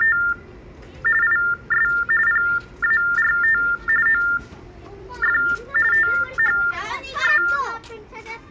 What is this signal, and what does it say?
TTY/TDD text telephone tones (45.45 baud Baudot), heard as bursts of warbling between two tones, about 400 Hz shift, 1600 Hz centre, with the noise of a residential street. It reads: … IS PART OF THE